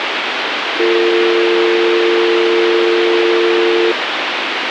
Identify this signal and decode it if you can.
Telephone call progress tone (North American or UK plan), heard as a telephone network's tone, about 350, 450 Hz, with phone line noise. Dial tone.